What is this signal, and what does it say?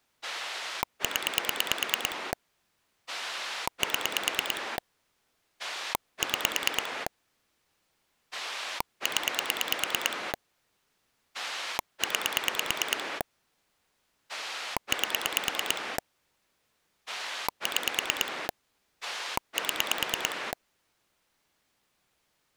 Pulse dialling, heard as a rotary dial, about 9 pulses a second. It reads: 0 7 6 0 9 8 6 7